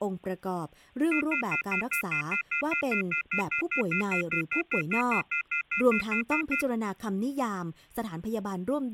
Telephone call progress tone (North American plan), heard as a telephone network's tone, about 1400, 2050, 2450, 2600 Hz, 0.1 s on and 0.1 s off, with speech in Thai. Off-hook warning tone.